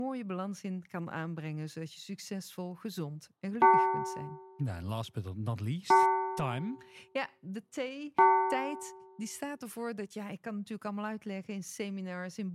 Clock strike, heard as a bell, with room echo and speech in Dutch. 3. Three o'clock.